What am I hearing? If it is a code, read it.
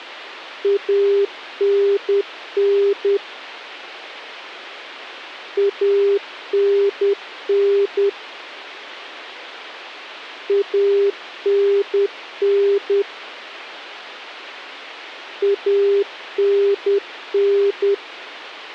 Morse code, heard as a keyed tone, machine-sent, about 10 wpm, 400 Hz. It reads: ANN ANN ANN ANN